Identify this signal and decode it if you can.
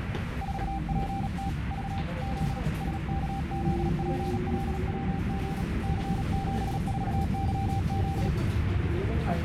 Morse code, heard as a keyed tone, hand-sent with a paddle, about 37 wpm, 780 Hz, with radio static and the noise inside a subway train. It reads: 4PT V Z SKZPLWG C74YZ